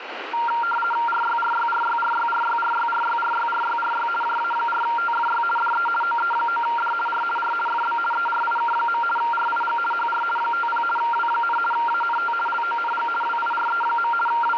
RTTY (50 baud, 450 Hz shift), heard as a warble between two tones, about 1160 Hz centre, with radio static. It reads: RYRYRYRYRYRYRYRYRYRY JA4TFY DE OE9D R R FB ERIK. RIG HR 50 W, ANT LONG WIRE. …